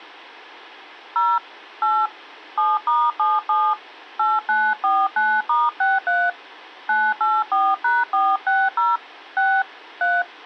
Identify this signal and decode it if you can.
DTMF, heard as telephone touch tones, dialled by hand, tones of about 220 ms. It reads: 0 8 7*77 8949*63 984#460 6 3